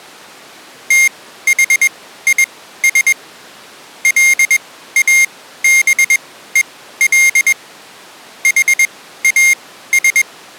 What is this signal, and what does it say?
Morse code, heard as a high beeper, machine-sent, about 21 wpm, spaced as for 14 wpm, 2100 Hz. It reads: THIS LABEL HAS